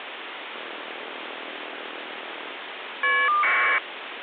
Caller ID data burst, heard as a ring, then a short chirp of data, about 1200 baud, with phone line noise.